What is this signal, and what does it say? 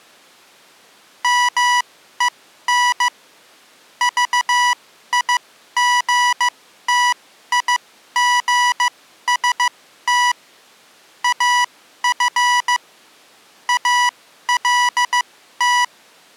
Morse code, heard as electronic beeps, machine-sent, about 15 wpm, spaced as for 12 wpm, 980 Hz. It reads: MEN VIGTIGST AF ALT